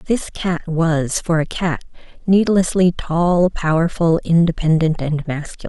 Speech in English. There is no code.